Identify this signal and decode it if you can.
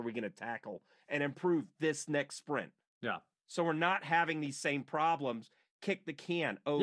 Speech in English. There is no code.